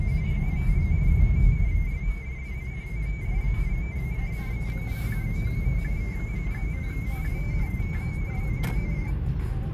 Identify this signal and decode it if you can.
Multi-tone FSK (Olivia or MFSK type), about 250 Hz wide, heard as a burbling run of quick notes, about 31.25 baud, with radio static and the noise inside a car.